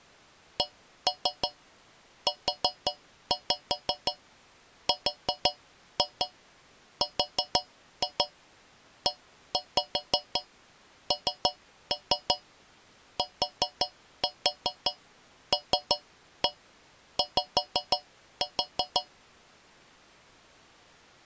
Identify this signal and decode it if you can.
Tap code, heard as taps on a metal pipe, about 5 knocks a second. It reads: CURRENTLY